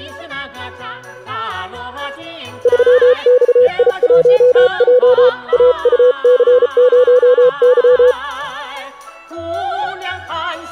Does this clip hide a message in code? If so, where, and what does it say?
Yes: Morse code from 2.6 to 8.2 s, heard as a keyed tone, hand-sent with a paddle, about 34 wpm, 500 Hz. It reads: 3XI1J AUC0Y